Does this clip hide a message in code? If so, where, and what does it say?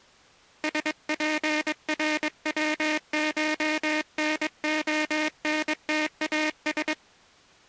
Yes: Morse code (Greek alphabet) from 0.6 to 7.0 s, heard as a buzzer, hand-sent with a paddle, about 22 wpm. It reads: ΣΠΡΩΧΝΟΝΤΑΣ